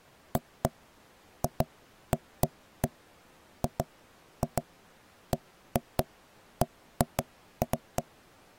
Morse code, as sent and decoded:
none

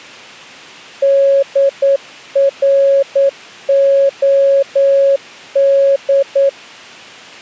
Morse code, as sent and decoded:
-.. .-. --- -..
DROD

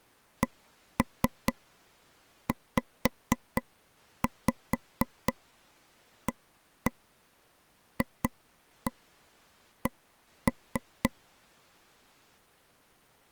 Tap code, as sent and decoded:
1-3 5-5 1-1 2-1 1-3
CZAFC

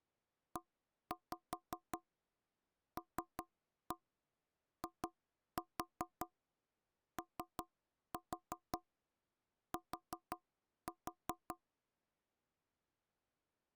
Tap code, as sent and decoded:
1-5 3-1 2-4 3-4 4-4
ELIOT

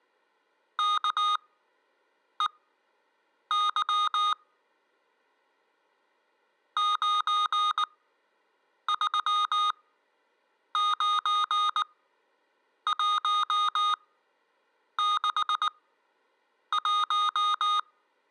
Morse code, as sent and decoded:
-.- . -.-- / ----. ...-- ----. .---- -.... .----
KEY 939161

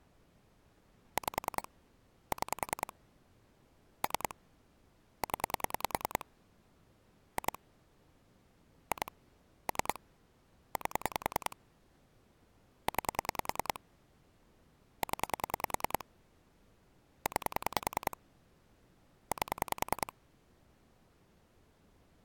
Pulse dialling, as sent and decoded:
5 / 6 / 3 / 10 / 2 / 2 / 3 / 8 / 9 / 10 / 9 / 8
5 6 3 0 2 2 3 8 9 0 9 8

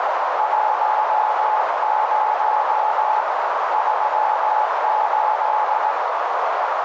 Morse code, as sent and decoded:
.---- ----- / ...-- ---..
10 38

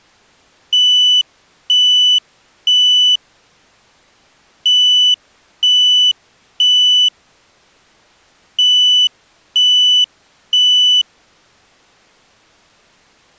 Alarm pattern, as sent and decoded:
3 beeps and a pause
temporal three

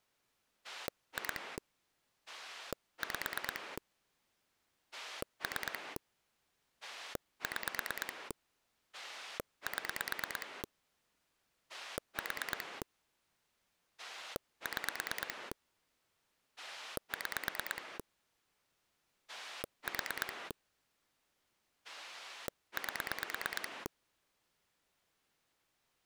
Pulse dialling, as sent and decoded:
2 / 5 / 3 / 6 / 7 / 4 / 6 / 6 / 4 / 8
2 5 3 6 7 4 6 6 4 8

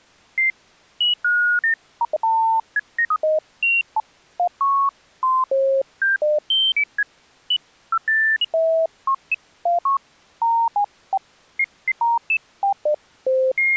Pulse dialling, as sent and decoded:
none

